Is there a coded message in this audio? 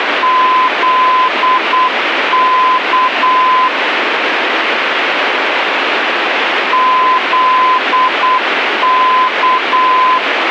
Yes: Morse code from 0.2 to 10.2 s, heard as a keyed tone, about 8 wpm, 1020 Hz, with radio static. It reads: ZK ZK